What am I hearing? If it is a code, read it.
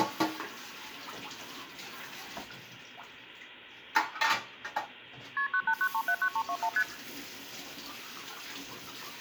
Multi-frequency trunk signalling (R1, as on North American trunks), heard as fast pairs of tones, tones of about 70 ms, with kitchen noise. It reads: KP 989379321 ST